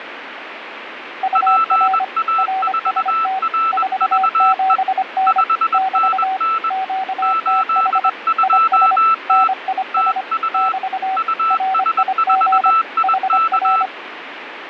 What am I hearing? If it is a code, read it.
Morse code, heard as two keyed tones, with radio static. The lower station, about 25 wpm, 760 Hz: UR RST 47N <BT> QTH IS NIS <BT> RIG HR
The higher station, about 21 wpm, 1320 Hz: PA4RVE 5NN 82T TU US4IK